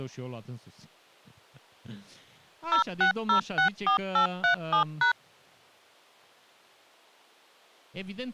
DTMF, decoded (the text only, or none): 06064837#